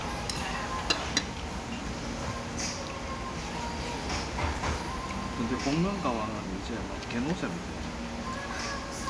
The noise of a restaurant. There is no code.